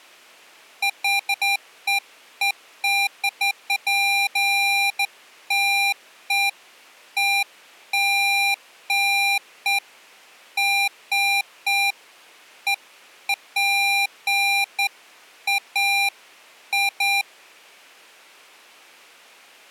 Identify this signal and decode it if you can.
Beeps of irregular length. There is no code.